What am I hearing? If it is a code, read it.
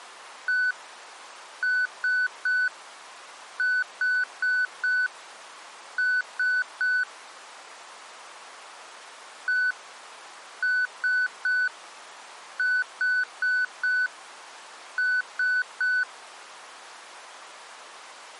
Beep code, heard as beeps, played twice, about 1500 Hz. 1-3-4-3. In Phoenix BIOS tables: memory failure on data bits.